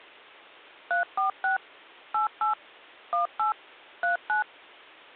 DTMF, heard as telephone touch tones, dialled by machine, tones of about 130 ms. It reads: 346 88 18 39